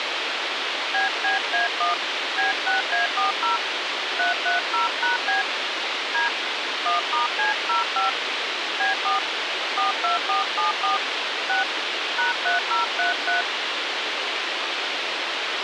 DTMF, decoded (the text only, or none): BBA1 B6A40 330#B D 1*C05 B4 42474 6 #3033